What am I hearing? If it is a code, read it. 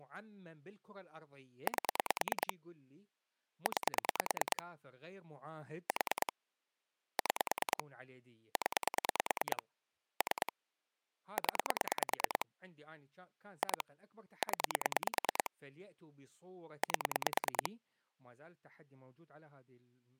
Pulse dialling, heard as clicks on a phone line, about 9 pulses a second, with speech in Arabic. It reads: 8 9 4 6 0 3 0 2 0 8